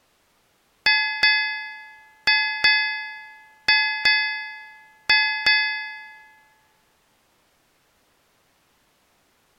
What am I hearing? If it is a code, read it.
Ship's bell, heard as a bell. 8. Eight half-hours of the watch have passed.